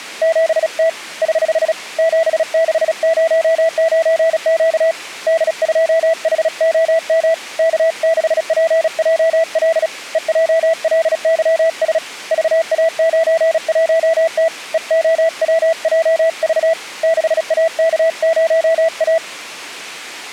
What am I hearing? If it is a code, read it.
Morse code, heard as a keyed tone, hand-sent with a paddle, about 36 wpm, 660 Hz. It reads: 7T <HH> 7609Q D2HOM K6PJL EJLYS VA91T EOWJV 6AK0A